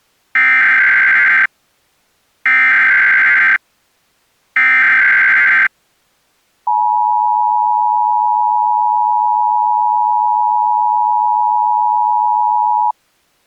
Emergency Alert System (SAME) tones (header bursts, then the 853 and 960 Hz attention tone), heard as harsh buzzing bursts, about 520.83 baud.